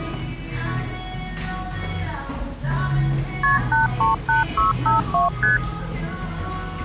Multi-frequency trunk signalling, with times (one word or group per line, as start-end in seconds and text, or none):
3.4-3.6 KP
3.7-5.3 838652
5.4-5.6 ST